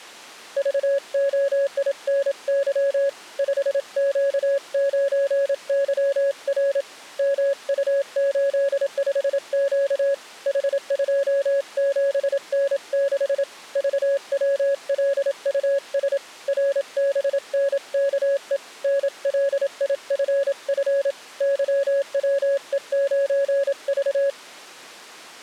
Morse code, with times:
0.6-3.1 VOINY
3.4-6.8 5Q9YR
7.2-10.1 MU85Q
10.5-13.4 H27N6
13.8-16.2 VWLUS
16.5-18.6 RBNKE
18.8-21.1 NLIFF
21.4-24.3 YWE9V

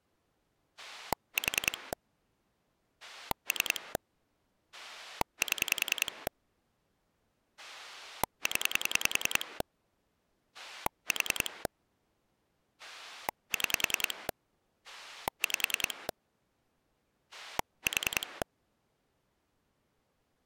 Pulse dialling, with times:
0.8-1.9 4
3.0-4.0 3
4.7-6.3 7
7.6-9.6 0
10.5-11.7 4
12.8-14.3 6
14.8-16.1 5
17.3-18.4 4

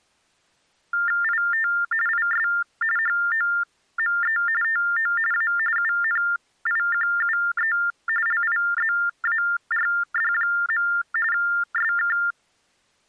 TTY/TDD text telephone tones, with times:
1.2-1.7 IT
2.1-2.5 IS
3.0-4.4 HOME
4.6-5.1 TO
5.3-5.5 A
5.8-7.8 UNIQUE
8.3-10.9 LIZARD.
11.3-12.2 SK

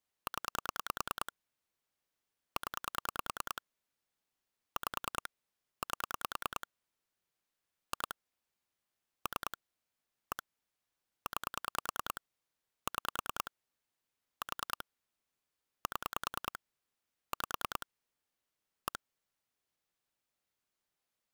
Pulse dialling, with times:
0.3-1.3 0
2.6-3.6 0
4.8-5.3 5
5.8-6.7 8
7.9-8.1 2
9.3-9.6 3
10.3-10.4 1
11.3-12.2 9
12.9-13.5 6
14.4-14.8 4
15.9-16.6 7
17.3-17.9 5
18.9-19.0 1

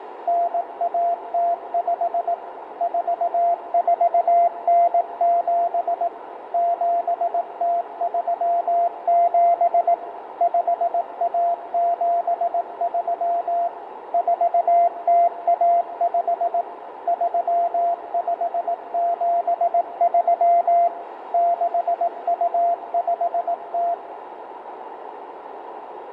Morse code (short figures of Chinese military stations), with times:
0.3-2.3 9105
2.8-6.1 4497
6.5-9.9 7037
10.4-13.7 5173
14.1-16.6 4015
17.1-20.9 3573
21.3-23.9 6250

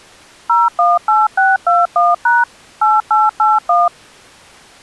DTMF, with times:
0.5-2.4 018621#
2.8-3.9 8881

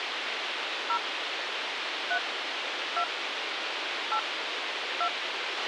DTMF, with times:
0.9-1.0 0
2.1-2.2 3
3.0-3.0 2
4.1-4.2 8
5.0-5.1 2

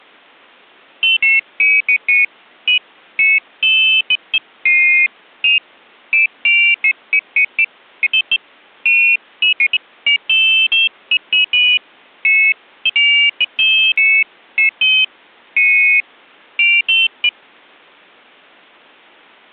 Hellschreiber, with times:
none

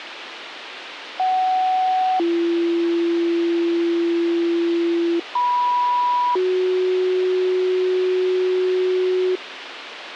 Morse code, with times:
none

